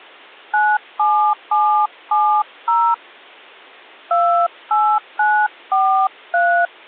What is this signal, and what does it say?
DTMF, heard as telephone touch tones, dialled by hand, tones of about 280 ms. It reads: 97770 28943